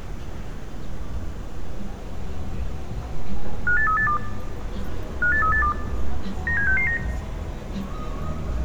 Five-tone selective call (CCIR), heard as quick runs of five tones, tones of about 100 ms, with street noise. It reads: 58382 58382 97669